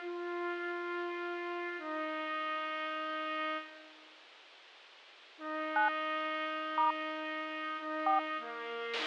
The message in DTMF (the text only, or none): 9 * 4